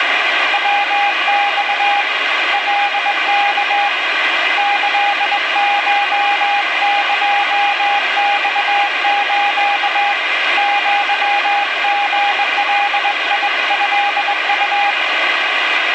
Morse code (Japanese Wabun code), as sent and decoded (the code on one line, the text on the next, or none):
.-- -..- / .-.. -.- / -.-.. ---- -.--- -..- ---.- / --.-- --. .-.. .. ..-.. ..-
ヤマ カワ キコエマス アリガトウ